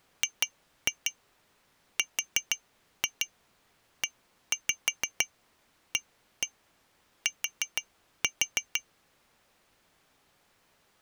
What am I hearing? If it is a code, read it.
Tap code, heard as taps on glass, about 6 knocks a second. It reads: GREAT